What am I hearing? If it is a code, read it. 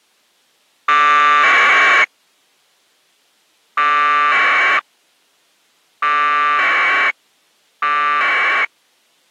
Packet radio (AX.25, as in APRS), 1200 baud, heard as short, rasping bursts.